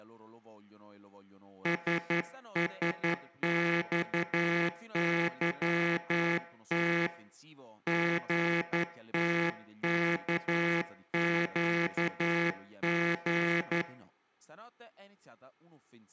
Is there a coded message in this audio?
Yes: Morse code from 1.6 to 13.9 s, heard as a buzzer, hand-sent with a straight key, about 11 wpm, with room echo and speech in Italian. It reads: SSXYT GTKQG